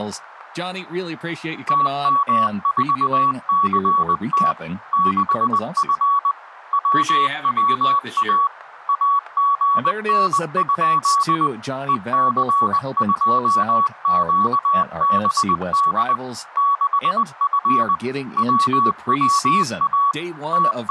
Morse code, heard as a keyed tone, machine-sent, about 20 wpm, 1130 Hz, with static crashes and speech in English. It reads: TM4CT 6F WWA AGN? EC2QBD 6F WWA …